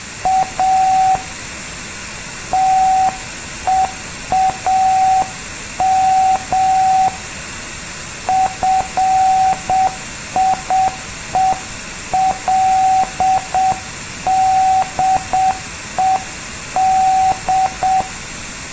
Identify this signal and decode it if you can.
Morse code, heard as a keyed tone, hand-sent with a paddle, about 7 wpm, 760 Hz. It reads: A TEAM FIELDED